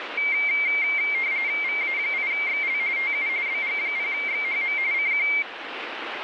RTTY (45.45 baud, 170 Hz shift), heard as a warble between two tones, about 2200 Hz centre, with radio static. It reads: VA8XL TU BG0XHM CQ